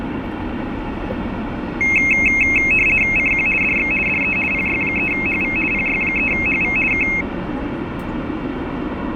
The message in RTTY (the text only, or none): CQ DX DE PY3HV PY3HV K